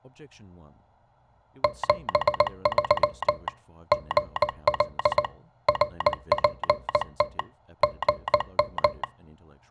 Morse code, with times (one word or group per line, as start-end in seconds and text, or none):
1.6-3.5 73
3.9-5.2 GL
5.7-7.4 RPT
7.8-9.0 GM